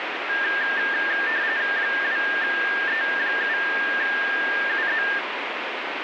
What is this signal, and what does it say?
RTTY (45.45 baud, 170 Hz shift), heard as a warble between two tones, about 1700 Hz centre, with radio static. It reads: 2E7UZ